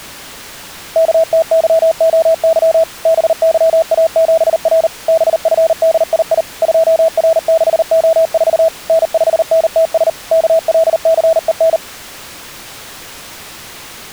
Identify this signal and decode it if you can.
Morse code, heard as a keyed tone, machine-sent, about 39 wpm, 650 Hz. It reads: KTYOY BYA7R BFDII 2R6O4 N5NTS KLCEN